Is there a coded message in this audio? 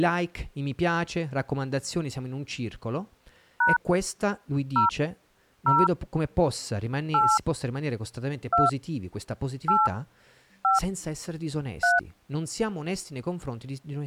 Yes: DTMF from 3.6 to 12.0 s, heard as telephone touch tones, dialled by hand, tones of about 170 ms, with speech in Italian. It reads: # 0 0 8 2 8 5 3